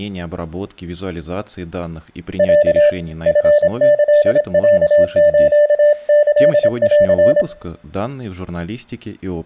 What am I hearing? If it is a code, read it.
Morse code (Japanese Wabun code), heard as a keyed tone, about 26 wpm, 590 Hz, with room echo and speech in Russian. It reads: ロ チキロスキン